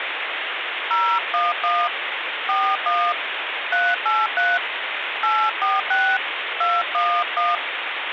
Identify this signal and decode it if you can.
DTMF, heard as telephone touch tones, dialled by hand, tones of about 230 ms, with phone line noise. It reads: 011 41 383 846 211